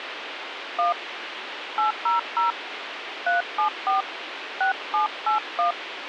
DTMF, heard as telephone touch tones, dialled by hand, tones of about 130 ms, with radio hiss. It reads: 1 800 374 6781